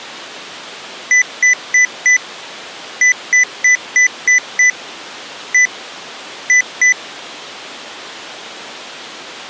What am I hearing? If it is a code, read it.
Beep code, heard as beeps from a small speaker, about 2000 Hz. 4-6-1-2.